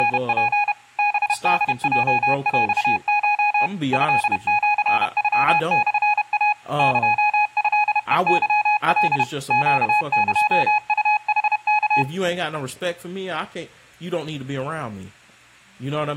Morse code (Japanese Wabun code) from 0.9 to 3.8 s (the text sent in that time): ハホヲヰコ